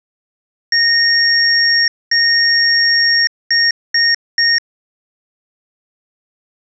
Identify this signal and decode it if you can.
Beep code, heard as beeps from a small speaker, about 1850 Hz. 2 long, 3 short.